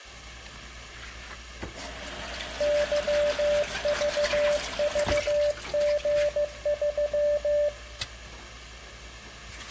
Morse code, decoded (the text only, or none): YVVG3